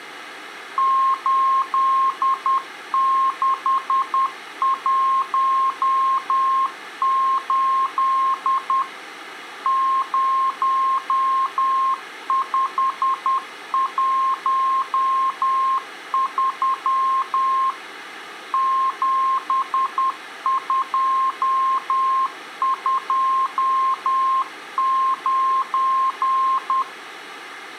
Morse code, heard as a keyed tone, machine-sent, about 10 wpm, 1060 Hz. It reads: 8618 0513 7229